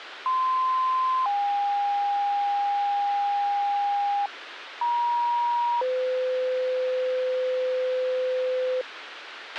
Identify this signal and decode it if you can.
Two-tone page, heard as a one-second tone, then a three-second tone, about 1040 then 810 Hz, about 950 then 510 Hz, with radio hiss and a squelch burst at the end.